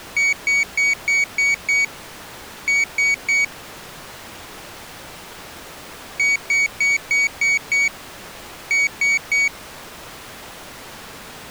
Beep code, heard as a piezo beeper, played twice, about 2250 Hz. 6-3.